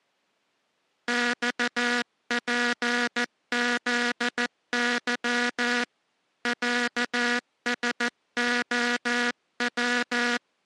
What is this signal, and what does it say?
Morse code (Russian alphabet), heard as a buzzer, hand-sent with a paddle, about 14 wpm. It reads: ЬПЗЫ ЯСОВ